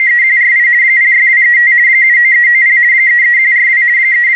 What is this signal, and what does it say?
RTTY (50 baud, 170 Hz shift), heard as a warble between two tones, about 2000 Hz centre, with radio static. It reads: … 06235 79390 33142 …